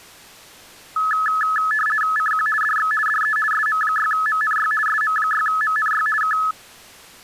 RTTY (50 baud, 450 Hz shift), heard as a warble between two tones, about 1500 Hz centre. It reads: CQ DX DE SM6MNY SM6MNY K